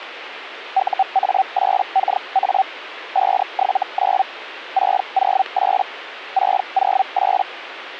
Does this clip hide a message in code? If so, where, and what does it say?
Yes: Hellschreiber (Feld-Hell, 122.5 baud) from 0.7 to 7.4 s, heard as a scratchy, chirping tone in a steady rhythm, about 770 Hz, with radio static. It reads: UA8KA 579 608 608